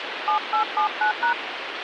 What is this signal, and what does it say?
DTMF, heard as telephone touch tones, dialled by hand, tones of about 100 ms, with phone line noise. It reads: 7879#